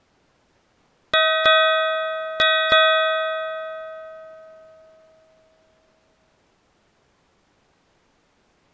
Ship's bell, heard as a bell. 4. Four half-hours of the watch have passed.